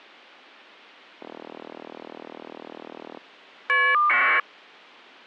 Caller ID data burst, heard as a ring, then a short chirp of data, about 1200 baud.